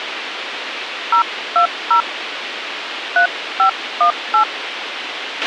DTMF, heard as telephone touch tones, dialled by hand, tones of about 100 ms, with radio hiss and a squelch burst at the end. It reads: 020 3518